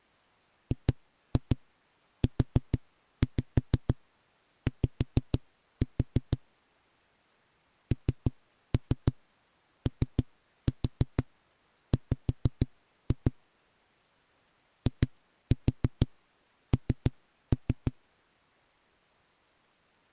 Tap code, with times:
0.7-6.4 GUY
7.9-13.3 NOW
14.9-17.9 IN

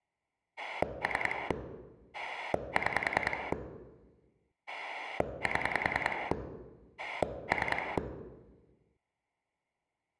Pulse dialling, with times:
0.6-1.5 3
2.1-3.5 6
4.7-6.3 7
7.0-8.0 3

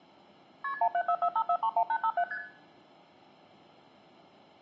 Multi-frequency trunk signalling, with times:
0.6-0.7 KP
0.8-2.2 17445431857
2.3-2.4 ST

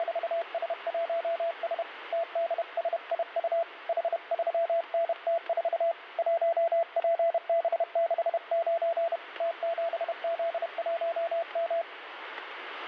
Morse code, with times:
0.0-1.8 …
2.1-3.6 TDSIU
3.9-5.9 H3NT4
6.2-9.2 1PB69
9.4-11.8 T7Z1M

